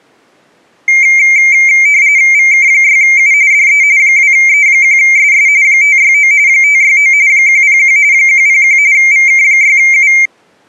RTTY (45.45 baud, 170 Hz shift), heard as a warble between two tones, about 2200 Hz centre. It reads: VK6U DE 2E1SS 569 569 101 101 VK6U